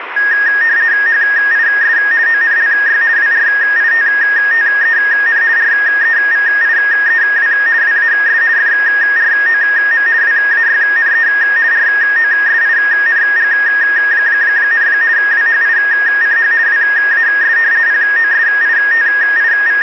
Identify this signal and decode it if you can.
RTTY (50 baud, 170 Hz shift), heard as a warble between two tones, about 1750 Hz centre, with radio static. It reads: HIS ONLY WRITTEN REVIEW WAS FROM WAYNE ROSING, WHICH WAS …